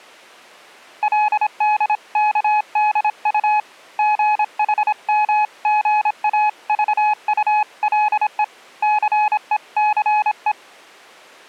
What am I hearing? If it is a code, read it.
Morse code (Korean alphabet), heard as a keyed tone, hand-sent with a paddle, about 26 wpm, 850 Hz. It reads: 그의 숨소리가 차차